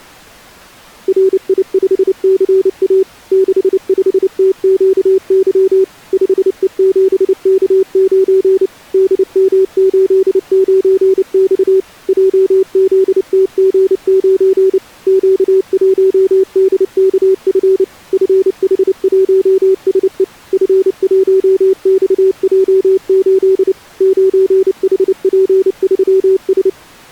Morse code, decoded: RI5CA 65TQY 5E7K9 DM89X JZTG9 Q1DKF FH1SE F1XJ8 9HP3S

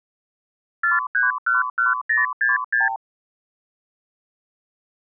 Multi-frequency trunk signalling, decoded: 4311066

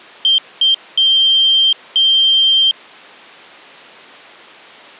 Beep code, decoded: 2 short, 2 long

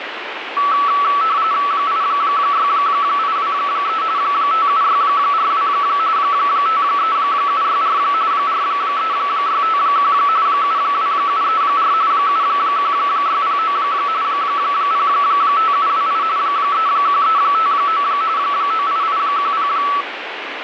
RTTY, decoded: 86823 57642 53764 43651 72734 71609 05728 31359 98810

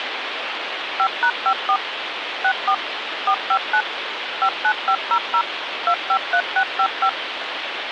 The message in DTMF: 5#54 64 459 59500 253655

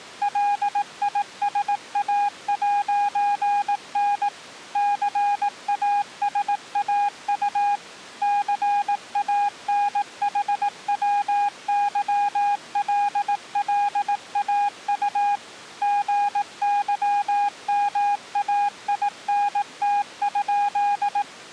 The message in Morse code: LISA'N CASAU CANHWYLLAU GYMAINT?

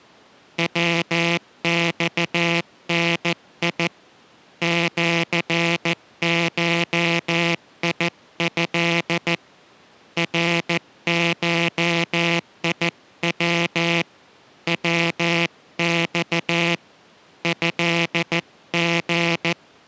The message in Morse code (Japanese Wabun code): ヤマダ シゴト ナゴヤ ヤマ トリ

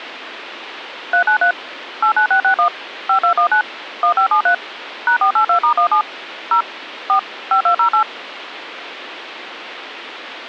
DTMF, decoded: 393 89661 5219 1573 #482*17 0 4 5208

